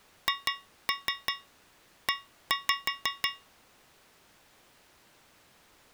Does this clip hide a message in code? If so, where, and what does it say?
Yes: tap code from 0.3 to 3.5 s, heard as taps on a metal pipe, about 6 knocks a second. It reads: HE